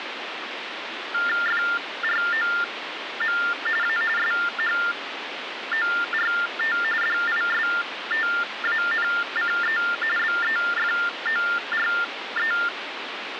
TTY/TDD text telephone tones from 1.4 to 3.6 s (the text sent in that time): FROM